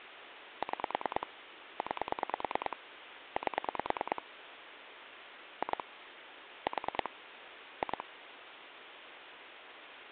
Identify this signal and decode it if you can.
Pulse dialling, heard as clicks on a phone line, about 9 pulses a second, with phone line noise. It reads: 6 9 8 2 4 2